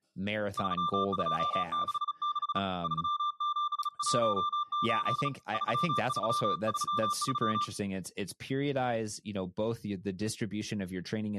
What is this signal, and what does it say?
Morse code, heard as a keyed tone, hand-sent with a bug key, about 36 wpm, 1180 Hz, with speech in English. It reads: 3266 3718 3333